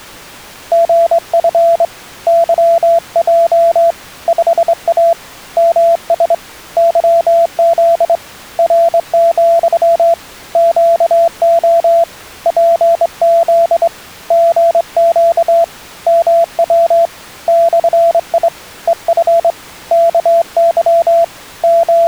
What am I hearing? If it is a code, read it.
Morse code, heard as a keyed tone, hand-sent with a straight key, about 24 wpm, 670 Hz. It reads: GF YJ 5A MS YZ R, QO PZ GQ MW /I EF KY …